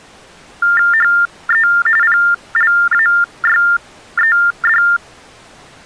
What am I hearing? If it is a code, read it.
TTY/TDD text telephone tones (45.45 baud Baudot), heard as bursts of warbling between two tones, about 400 Hz shift, 1600 Hz centre. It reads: HE PLAYED